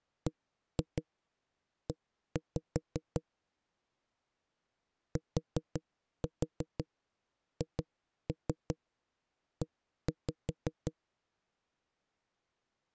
Tap code, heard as knocks on a wall, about 5 knocks a second. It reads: BE THE